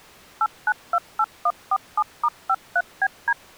DTMF, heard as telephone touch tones, dialled by machine, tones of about 50 ms. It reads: 8928147*53BD